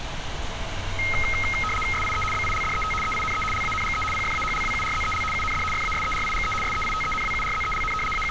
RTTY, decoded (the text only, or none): SIE BILDET EINE LANGE PFAHLWURZEL UND FASERIGE SEITENWURZELN …